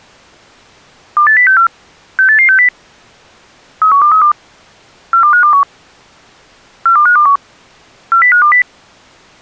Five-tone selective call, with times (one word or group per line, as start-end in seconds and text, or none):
1.2-1.7 28064
2.2-2.7 68860
3.8-4.3 31232
5.1-5.6 42521
6.9-7.4 42521
8.1-8.6 40520